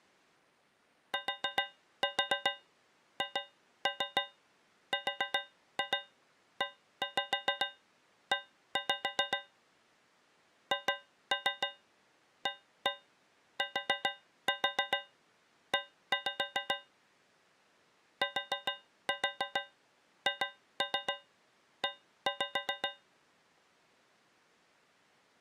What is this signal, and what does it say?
Tap code, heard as taps on a metal pipe, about 7 knocks a second. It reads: THREE HATE THE